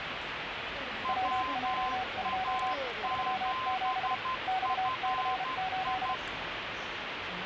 Morse code, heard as two keyed tones, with radio static and the noise of a subway station. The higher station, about 12 wpm, 1040 Hz: WA7FI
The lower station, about 32 wpm, 750 Hz: WJ2 37 XC8